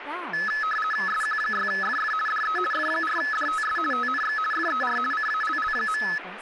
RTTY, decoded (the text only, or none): SQ6FF DE F4DTS TNX FER CALL.